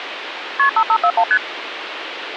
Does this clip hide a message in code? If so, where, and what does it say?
Yes: multi-frequency trunk signalling (R1, as on North American trunks) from 0.6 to 1.4 s, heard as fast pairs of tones, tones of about 70 ms, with phone line noise. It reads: KP 5541 ST